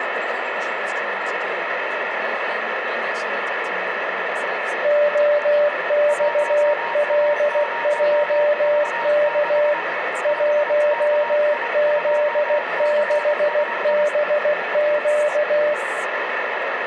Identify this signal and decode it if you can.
Morse code, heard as two keyed tones, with radio static. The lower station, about 16 wpm, 590 Hz: OXLJK 1Z6BQ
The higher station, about 24 wpm, 940 Hz: 1A0V6 5KI2CSI